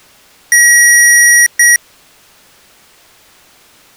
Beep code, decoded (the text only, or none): 1 long, 1 short